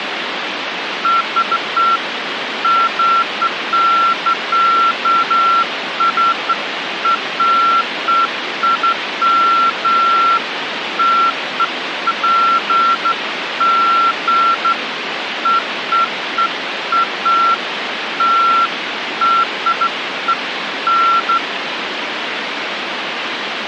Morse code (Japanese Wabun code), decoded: none

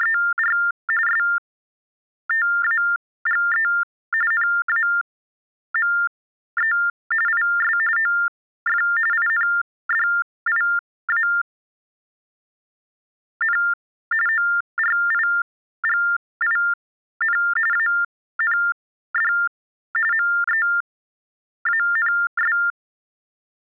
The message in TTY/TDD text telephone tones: … STAGE NAME IS OF INDIAN ORIGIN AND MEANS

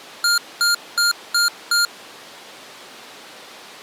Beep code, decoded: 5 short

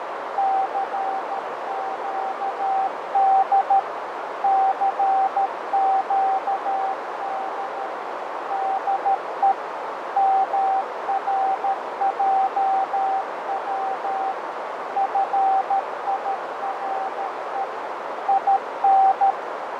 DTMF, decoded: none

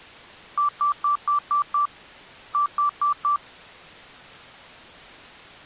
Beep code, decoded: 6-4

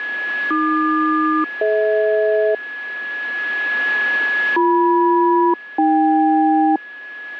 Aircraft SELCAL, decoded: AQ-DH BM-AK

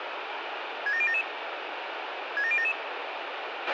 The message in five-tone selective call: 67077 67077

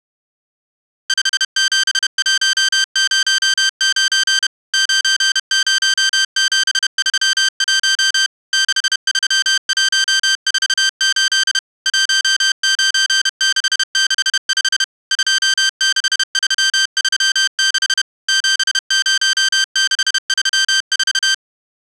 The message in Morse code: 57109 90731 63148 19665 26336 70634

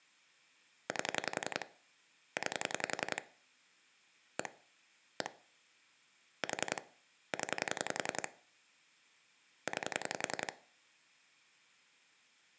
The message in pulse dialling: 8 9 1 1 4 0 9

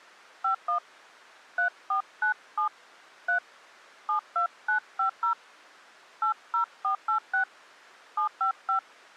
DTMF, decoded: 51 3497 3 72950 80486 755

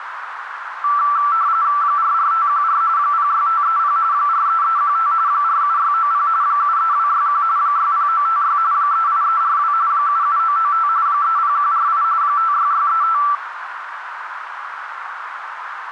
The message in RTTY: 44514 06530 43315 47690 73261 60956 38342 77995 30148 56635

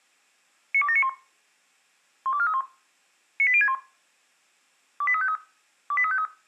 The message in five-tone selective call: 92791 12431 98061 28353 28353

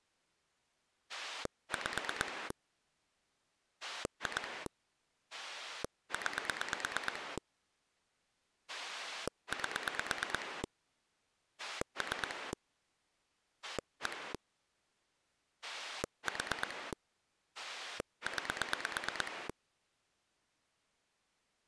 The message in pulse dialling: 5 2 9 8 3 1 4 9

